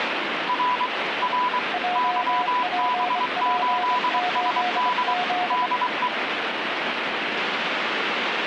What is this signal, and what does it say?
Morse code, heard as two keyed tones, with radio static. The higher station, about 23 wpm, 990 Hz: R R YB8SD DE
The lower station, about 25 wpm, 720 Hz: JPP8Z